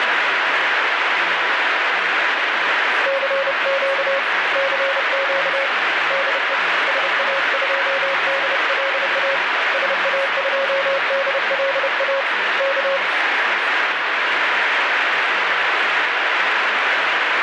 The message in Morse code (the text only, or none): CQ CQ DE SA2DLA SA2DLA K